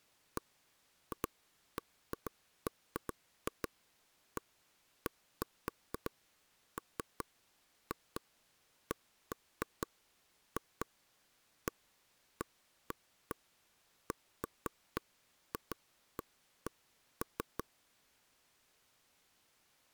Irregular taps on a table. There is no code.